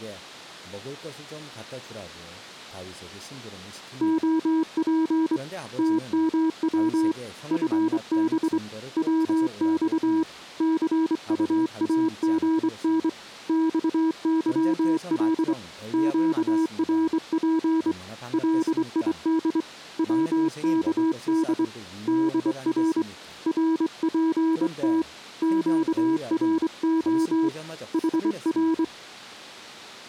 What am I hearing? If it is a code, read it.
Morse code, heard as a keyed tone, hand-sent with a straight key, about 24 wpm, 320 Hz, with speech in Korean. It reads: OP TMW FB WX CUAGN XYL QRP LID WKD DR RPT QRO HR